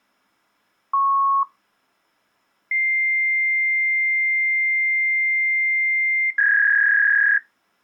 Fax machine handshake, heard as a beep, a long tone and a warble.